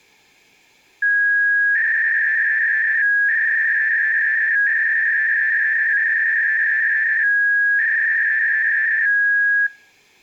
300-baud modem data (V.21 tones), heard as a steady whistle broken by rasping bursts, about 300 baud, 200 Hz shift.